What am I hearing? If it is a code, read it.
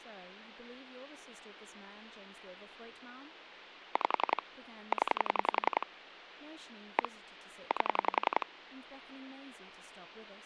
Pulse dialling, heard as clicks on a phone line, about 11 pulses a second, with phone line noise and speech in English. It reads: 5 0 1 8